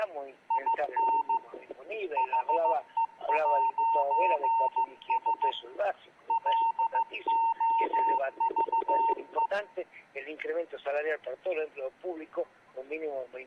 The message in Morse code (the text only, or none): IN HE'S LOVE